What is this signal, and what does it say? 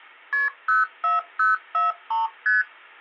Multi-frequency trunk signalling (R1, as on North American trunks), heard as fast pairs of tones, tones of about 160 ms. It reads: KP 04043 ST